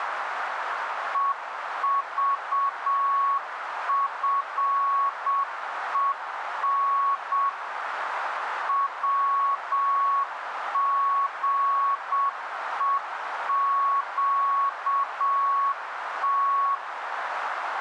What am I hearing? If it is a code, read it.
Morse code, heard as a keyed tone, machine-sent, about 7 wpm, 1110 Hz, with radio static and a narrow filter. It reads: EVFEN WGEQT